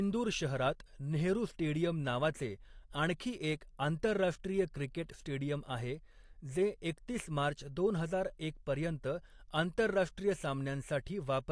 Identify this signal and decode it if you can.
Speech in Marathi. There is no code.